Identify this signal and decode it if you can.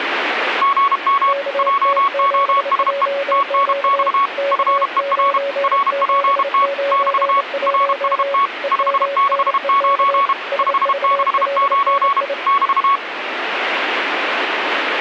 Morse code, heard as two keyed tones, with radio static. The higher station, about 32 wpm, 1120 Hz: GM JOSE TNX FER RPT <BT> RST 569 569 <BT>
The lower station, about 28 wpm, 560 Hz: KT7JQ K9791 EMNEK SVLNI